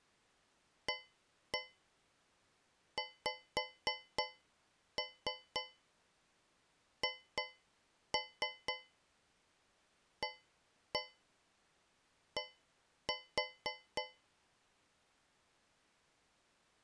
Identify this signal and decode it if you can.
Tap code, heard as taps on a metal pipe, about 3 knocks a second. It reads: AXHAD